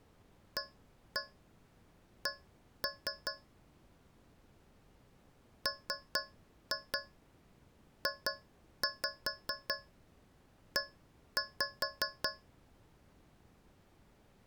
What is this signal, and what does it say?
Tap code, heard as taps on a metal pipe, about 4 knocks a second. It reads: AC MJE